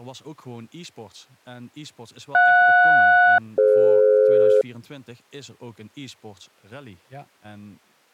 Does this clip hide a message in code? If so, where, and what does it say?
Yes: aircraft SELCAL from 2.3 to 4.6 s, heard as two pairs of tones, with speech in Dutch. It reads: JS-DF